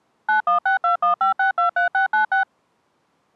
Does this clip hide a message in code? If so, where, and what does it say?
Yes: DTMF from 0.3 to 2.4 s, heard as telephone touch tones, dialled by machine, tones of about 120 ms. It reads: 916215623696